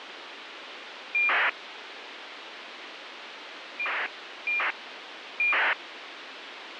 ACARS aircraft data, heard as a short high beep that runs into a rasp, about 2400 baud, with radio hiss.